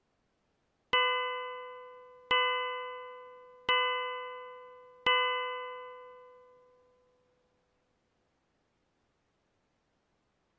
Clock strike, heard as a bell. 4. Four o'clock.